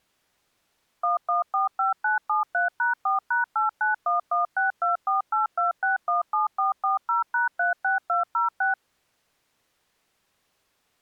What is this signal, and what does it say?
DTMF, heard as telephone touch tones, dialled by machine, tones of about 140 ms. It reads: 1145973#4#891162482617440#36206